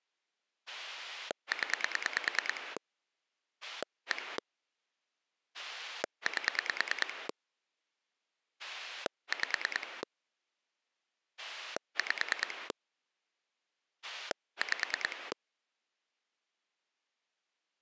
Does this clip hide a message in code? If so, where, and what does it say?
Yes: pulse dialling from 0.7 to 15.3 s, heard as a rotary dial, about 9 pulses a second. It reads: 0 1 8 5 5 5